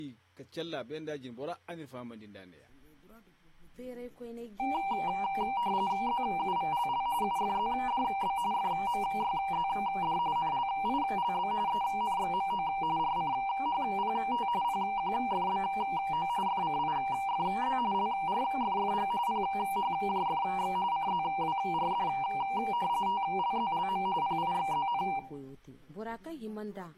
RTTY (45.45 baud, 170 Hz shift), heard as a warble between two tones, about 870 Hz centre, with room echo. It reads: ZUVLL UFZDB FMYZD NLILB ENXMO RCHPT PQFBO FCIFZ LRFFG PHJFX CZWRD TLZLM PIXZN